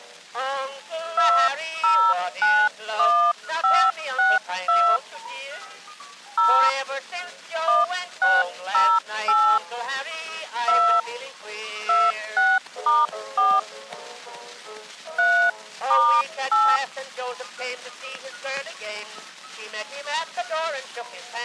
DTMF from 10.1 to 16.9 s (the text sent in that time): 2 26*4 3*8